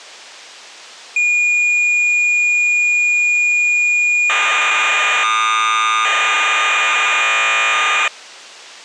Cassette data (Kansas City type), 1200 baud, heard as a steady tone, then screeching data.